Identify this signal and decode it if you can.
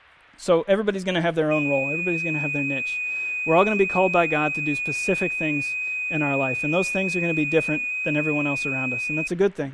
FT8 (one signal), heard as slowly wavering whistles, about 6.25 baud, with speech in English.